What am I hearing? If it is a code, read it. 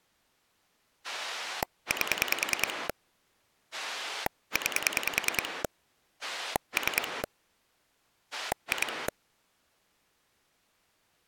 Pulse dialling, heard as a rotary dial, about 10 pulses a second. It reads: 8 9 3 2